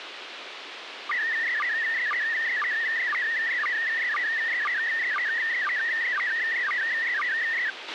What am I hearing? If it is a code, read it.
SSTV (slow-scan television), PD 120, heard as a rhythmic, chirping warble, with radio hiss and a squelch burst at the end.